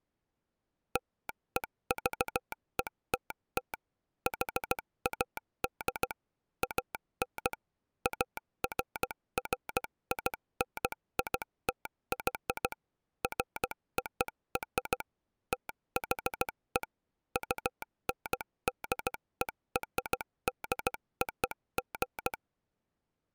Morse code (American railroad code), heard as a telegraph sounder, machine-sent. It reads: LEVETT HAD AN AFFINITY FOR THE UNDERDOG